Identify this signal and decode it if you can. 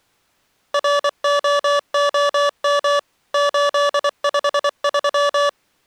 Morse code, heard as electronic beeps, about 24 wpm, 580 Hz. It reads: ROOM 853